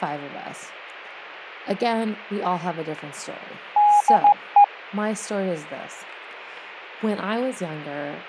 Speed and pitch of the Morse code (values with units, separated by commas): 15 wpm, 820 Hz